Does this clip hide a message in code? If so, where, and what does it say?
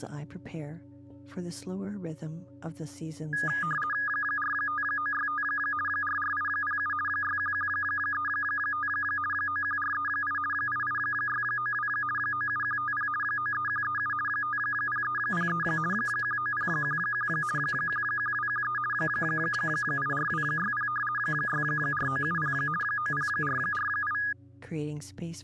Yes: RTTY (50 baud, 450 Hz shift) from 3.3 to 24.3 s, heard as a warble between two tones, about 1440 Hz centre. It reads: 45965 44807 61135 91438 88692 97150 93137 50303 19011 11213 84260 64970 90448